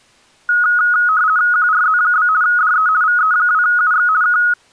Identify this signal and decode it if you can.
RTTY (50 baud, 170 Hz shift), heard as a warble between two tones, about 1360 Hz centre. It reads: QRZ? DE VE2UX K